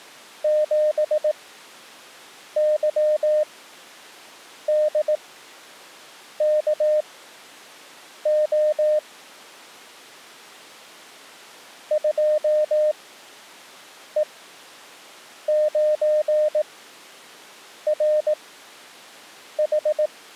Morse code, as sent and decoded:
--... -.-- -.. -.- --- / ..--- . ----. .-. ....
7YDKO 2E9RH

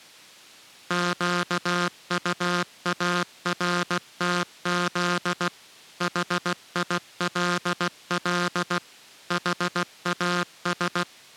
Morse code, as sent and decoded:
--.- ..- .- .-. - --.. / .... .. .-.. .-.. / .... .- ...
QUARTZ HILL HAS

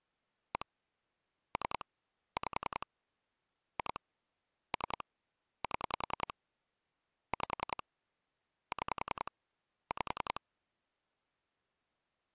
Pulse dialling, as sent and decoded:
1 / 3 / 5 / 2 / 3 / 7 / 5 / 6 / 5
1 3 5 2 3 7 5 6 5

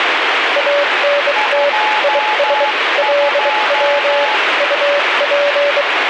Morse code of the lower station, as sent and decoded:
.- -. - / .. ... / .-.. .-- / ..- .--.
ANT IS LW UP

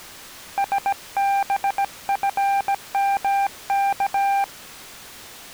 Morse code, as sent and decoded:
... -... ..-. -- -.-
SBFMK

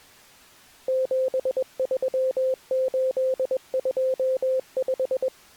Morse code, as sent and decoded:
--... ...-- ---.. ..--- .....
73825

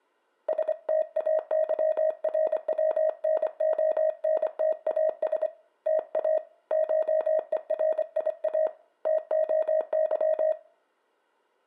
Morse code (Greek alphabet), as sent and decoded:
... - .- -.-- .-. .-- -. --- -. - .- ... / - .- / ---- . .-. .. .- / - --- -.--
ΣΤΑΥΡΩΝΟΝΤΑΣ ΤΑ ΧΕΡΙΑ ΤΟΥ

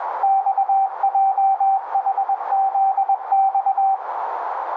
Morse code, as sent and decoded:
-..- .--- .... --.. -..-
XJHZX

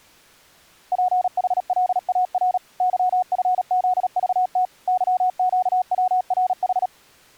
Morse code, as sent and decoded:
.--. .... .-.. .- .-. / -.-- ..-. --.. ...- - / -.-- --.- .-- .-. ....
PHLAR YFZVT YQWRH

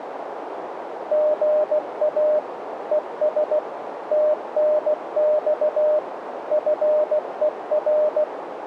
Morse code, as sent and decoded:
--. .- / . ... / - -. -..- / ..-. . .-.
GA ES TNX FER

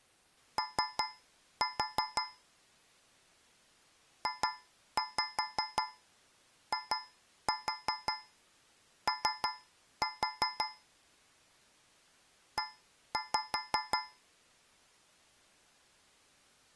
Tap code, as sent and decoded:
3-4 / 2-5 2-4 3-4 / 1-5
O JIO E

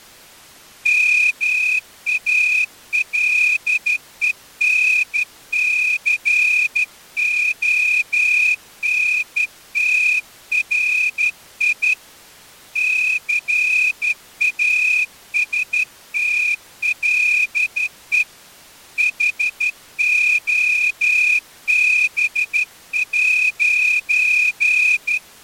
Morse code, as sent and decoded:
-- .- .-.. . -. -.-. --- -. - .-. .. / -.-. .- ... - .-.. . / .... --- -... .----.
MALENCONTRI CASTLE HOB'

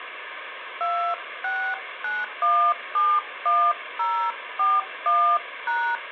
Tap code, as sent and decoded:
none

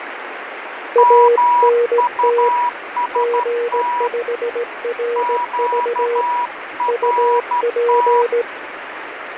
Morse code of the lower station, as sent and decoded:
.- -. - / --. ..... .-. ...- / ..- .--.
ANT G5RV UP

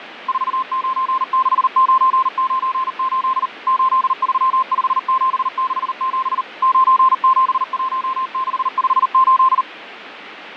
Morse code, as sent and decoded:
....- ----. -.... ----. ----. ---.. / ---.. ...-- ..... --... -.... --... / ----. --... .---- -.... ..... ---..
496998 835767 971658

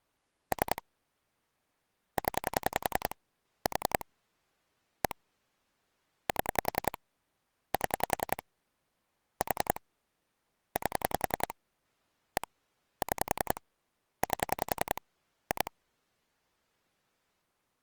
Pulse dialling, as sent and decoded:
3 / 10 / 4 / 1 / 7 / 7 / 4 / 8 / 1 / 6 / 8 / 2
3 0 4 1 7 7 4 8 1 6 8 2

